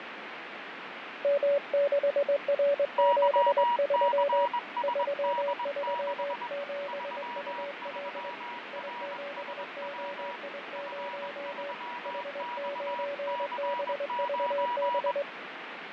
Morse code, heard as two keyed tones, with radio static and fading. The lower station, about 22 wpm, 570 Hz: M6R73 337UL I7OI0 H9BVB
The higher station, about 21 wpm, 960 Hz: YCSD6 33RSW F3XC9